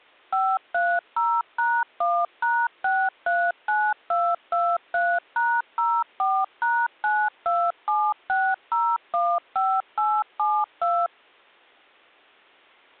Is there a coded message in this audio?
Yes: DTMF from 0.3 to 11.1 s, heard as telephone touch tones, dialled by machine, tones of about 250 ms. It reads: 530#1#639223#04#9276015872